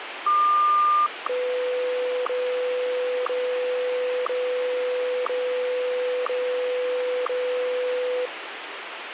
Radio time signal (WWVH, Hawaii), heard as ticks, one a second, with radio static.